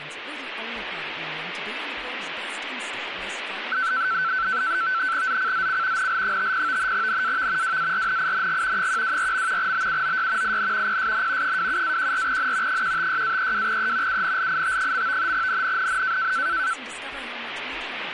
NAVTEX (SITOR-B), 100 baud, 170 Hz shift, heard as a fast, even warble, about 1430 Hz centre, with radio static. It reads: ZCZC NL50 NAV WARNING 124. BUOY IN PSN 27-14N 156-32E UNLIT. NNNN